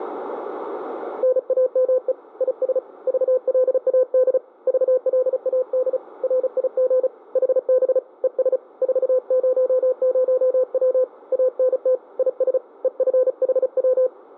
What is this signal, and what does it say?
Morse code, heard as a keyed tone, hand-sent with a paddle, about 35 wpm, 510 Hz, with radio static and room echo. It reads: NAME IS VLAD VLAD RIG HB ES 400W ANT IS EFHW